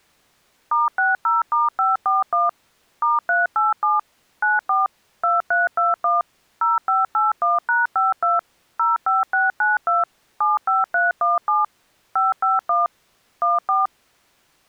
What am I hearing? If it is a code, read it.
DTMF, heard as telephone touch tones, dialled by machine, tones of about 170 ms. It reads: *60*541 *387 94 2321 0581#52 05692 75317 551 14